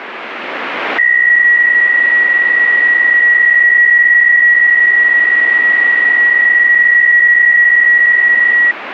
PSK63 (62.5 baud), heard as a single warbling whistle, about 1900 Hz, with radio static.